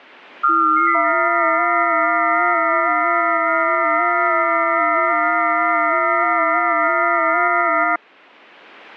FT8 (several signals at once), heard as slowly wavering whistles, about 6.25 baud.